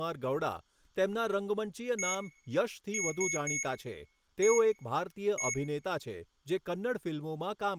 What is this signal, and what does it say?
Beep code, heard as beeps from a small speaker, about 2200 Hz, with room echo and speech in Gujarati. 1-3-1-1. In Phoenix BIOS tables: memory refresh test failure.